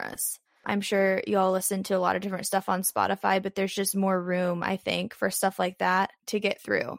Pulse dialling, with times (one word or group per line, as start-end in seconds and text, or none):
none